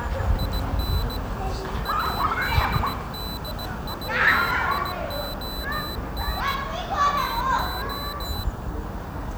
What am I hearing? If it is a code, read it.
Morse code, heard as a high beeper, hand-sent with a paddle, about 17 wpm, 4000 Hz, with the noise of a residential street. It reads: IN ADDITION TO